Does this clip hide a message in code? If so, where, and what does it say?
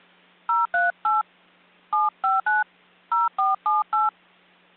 Yes: DTMF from 0.5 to 4.1 s, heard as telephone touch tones, dialled by hand, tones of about 160 ms. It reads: 038 759 0478